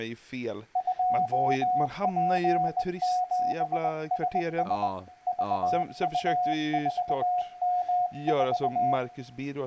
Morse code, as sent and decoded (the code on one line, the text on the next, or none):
..--- .--. --... ... ... / ...- ..- ....- -- ....-
2P7SS VU4M4